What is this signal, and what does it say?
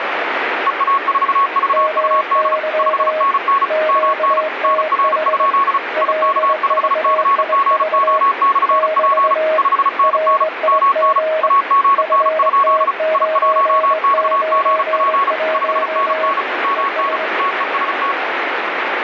Morse code, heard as two keyed tones, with heavy radio static. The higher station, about 35 wpm, 1110 Hz: EA4VUD 5NN MN NR? IK5CGO/P 5NN MN AGN? I1XGP 5NN MN TEST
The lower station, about 21 wpm, 630 Hz: MY QTH LVIV <BT> RIG FT991 ES